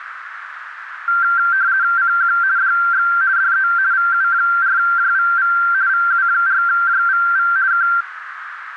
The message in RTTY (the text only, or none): CQ DX DE VU4JVV VU4JVV K